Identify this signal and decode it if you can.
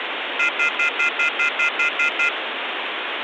Telephone call progress tone (North American plan), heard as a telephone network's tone, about 1400, 2050, 2450, 2600 Hz, 0.1 s on and 0.1 s off, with phone line noise. Off-hook warning tone.